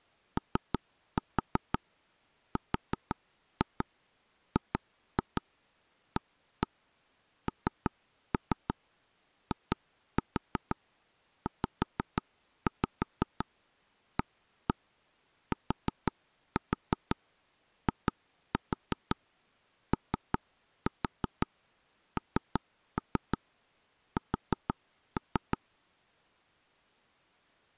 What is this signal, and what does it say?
Tap code, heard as taps on a table, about 5 knocks a second. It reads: ORGANIZATIONS